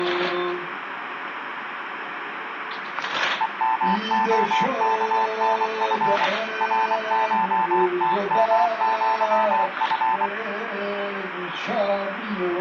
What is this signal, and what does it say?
Morse code (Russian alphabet), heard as a keyed tone, machine-sent, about 24 wpm, 890 Hz, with radio static. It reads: ЕМОКНФ РШТМЪФ